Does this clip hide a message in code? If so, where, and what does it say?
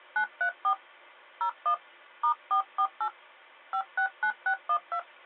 Yes: DTMF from 0.2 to 5.0 s, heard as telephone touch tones, dialled by hand, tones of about 90 ms. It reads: 934 01 *448 569612